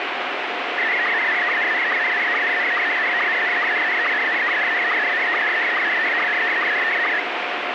SSTV (slow-scan television), Scottie S1, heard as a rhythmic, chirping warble, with heavy radio static.